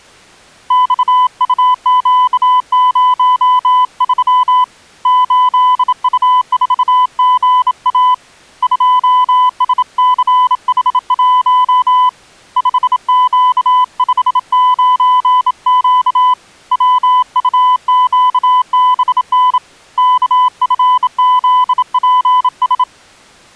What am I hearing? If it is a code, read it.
Morse code, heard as a keyed tone, hand-sent with a bug key, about 27 wpm, 1000 Hz. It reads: XUQ03 8U4GA 2SCH1 5Q59Q WUQBN KFZPS